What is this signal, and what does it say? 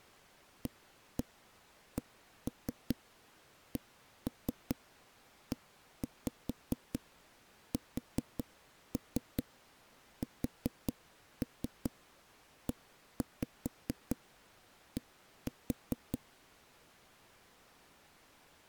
Tap code, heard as knocks on a wall, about 4 knocks a second. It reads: ACCESSED